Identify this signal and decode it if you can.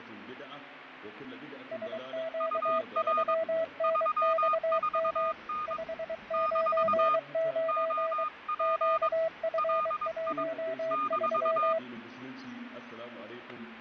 Morse code, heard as two keyed tones, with radio static and fading. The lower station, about 23 wpm, 650 Hz: SQ3NXM 599 QF13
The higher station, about 22 wpm, 1230 Hz: UR 34N - OP LI -